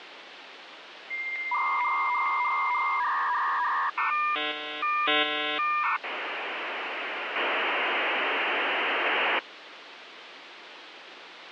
Dial-up modem handshake (V.34 or later), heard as a whistle, warbles, then hiss, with phone line noise.